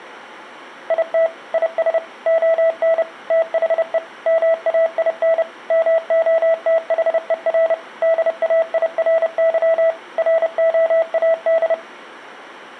Morse code, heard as a keyed tone, machine-sent, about 30 wpm, 660 Hz. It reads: IT IS ON THE MAIN MOTHER DAIRY ROAD